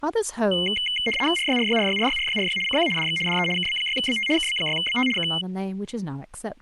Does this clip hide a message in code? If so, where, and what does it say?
Yes: RTTY (75 baud, 850 Hz shift) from 0.5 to 5.4 s, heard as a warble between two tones, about 2550 Hz centre, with speech in English. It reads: RYRYRYRYRYRY CQ DX DE KB6BT KB6BT K